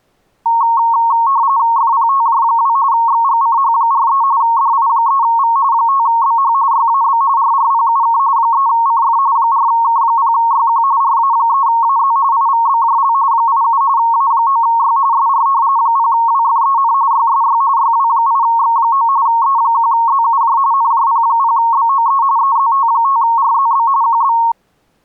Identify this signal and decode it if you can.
RTTY (45.45 baud, 170 Hz shift), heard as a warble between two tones, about 1010 Hz centre. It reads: FPTJ2 XGCH43 DI3V 5BH YAB RRPUK 3CF 4K0YQ RA3AZ IVBJL 87 A9Y SR 0WFEN YSY YW8X9 E1ZUJ NJP0BOE EZT5RZB QB